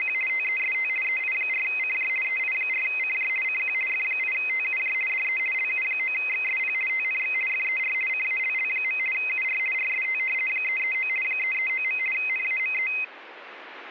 RTTY (50 baud, 450 Hz shift), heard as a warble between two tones, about 2300 Hz centre. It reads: … TEST EI4CJ EI4CJ CQ F8TUJ DE LU9XSP TNX FER CALL. UR RST 339 339. NAME